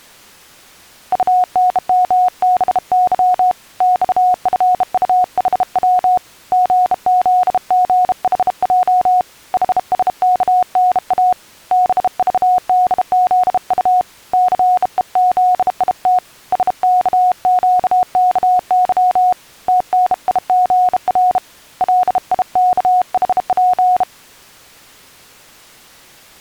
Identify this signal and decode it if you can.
Morse code, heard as a keyed tone, hand-sent with a bug key, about 32 wpm, 730 Hz. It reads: UNMBY XFUHW GZGHJ HSKNA BVDZU CEZIT SKQKY TNIGR LIKHP